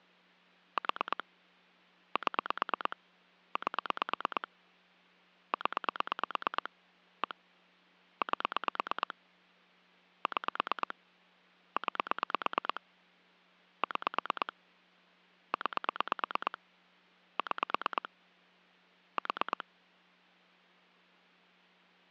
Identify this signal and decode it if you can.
Pulse dialling, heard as clicks on a phone line, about 9 pulses a second. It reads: 4 7 8 0 1 8 6 9 6 9 6 4